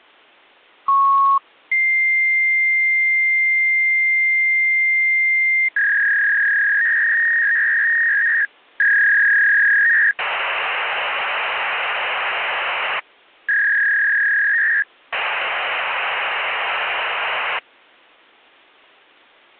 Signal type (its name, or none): fax machine handshake